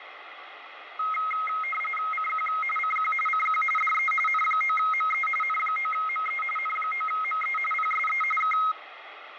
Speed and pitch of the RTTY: 45.45 baud, 850 Hz shift, 1700 Hz centre

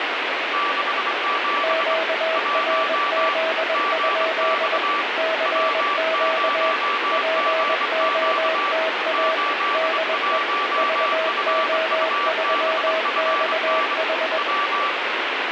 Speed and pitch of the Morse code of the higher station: 24 wpm, 1160 Hz

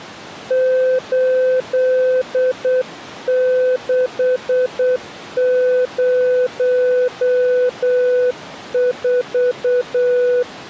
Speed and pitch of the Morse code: 8 wpm, 500 Hz

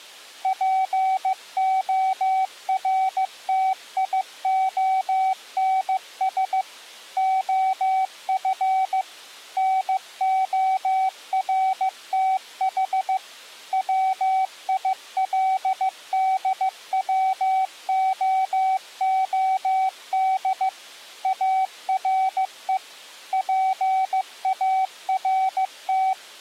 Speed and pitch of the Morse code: 15 wpm, 760 Hz

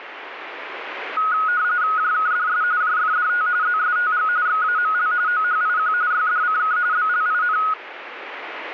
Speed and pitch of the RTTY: 45.45 baud, 170 Hz shift, 1360 Hz centre

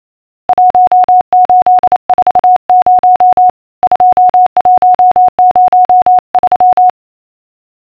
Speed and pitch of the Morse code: 28 wpm, 730 Hz

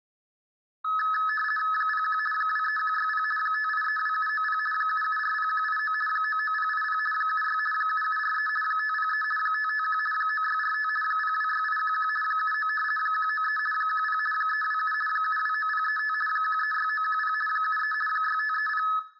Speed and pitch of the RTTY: 50 baud, 450 Hz shift, 1500 Hz centre

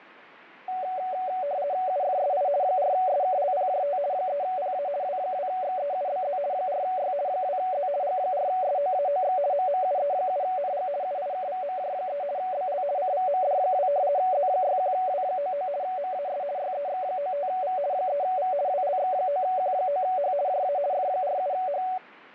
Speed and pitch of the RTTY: 50 baud, 170 Hz shift, 660 Hz centre

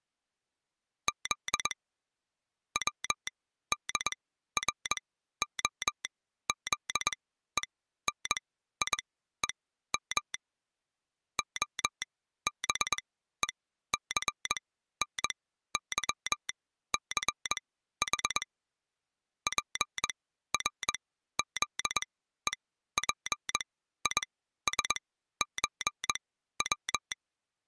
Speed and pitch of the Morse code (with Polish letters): 21 wpm, spaced as for 13 wpm

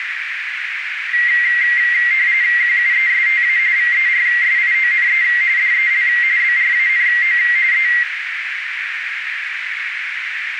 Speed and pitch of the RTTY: 45.45 baud, 170 Hz shift, 2000 Hz centre

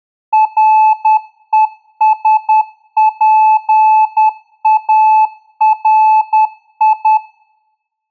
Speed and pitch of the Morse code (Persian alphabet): 10 wpm, 870 Hz

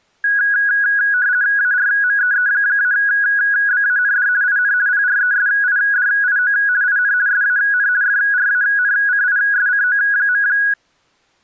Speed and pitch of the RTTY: 50 baud, 170 Hz shift, 1550 Hz centre

